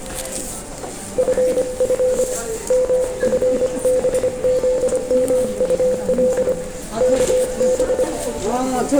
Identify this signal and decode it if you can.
Morse code, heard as a keyed tone, hand-sent with a paddle, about 25 wpm, 510 Hz, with room echo and the noise of a crowd indoors. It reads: FF MFBZMUL KB